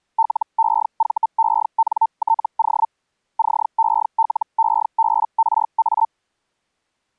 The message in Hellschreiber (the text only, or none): LEVENTO CELEBRA